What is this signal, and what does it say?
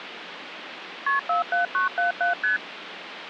Multi-frequency trunk signalling (R1, as on North American trunks), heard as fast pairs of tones, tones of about 130 ms, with phone line noise. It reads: KP 47977 ST